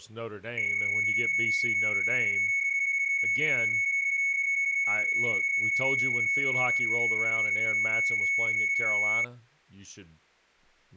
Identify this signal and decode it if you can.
PSK31 (31.25 baud), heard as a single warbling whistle, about 2200 Hz, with speech in English.